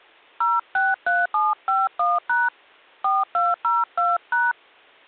DTMF, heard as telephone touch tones, dialled by hand, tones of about 190 ms. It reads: 063751# 4202#